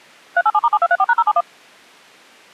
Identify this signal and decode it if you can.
DTMF, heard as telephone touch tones, dialled by machine, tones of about 50 ms. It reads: 387*7234#071